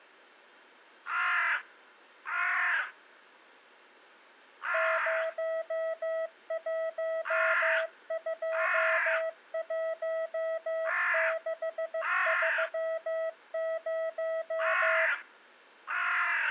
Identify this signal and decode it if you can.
Morse code, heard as a keyed tone, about 15 wpm, 650 Hz. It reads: 0121630